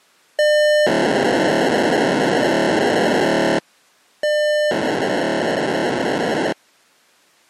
POCSAG pager data (1200 baud), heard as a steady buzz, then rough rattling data.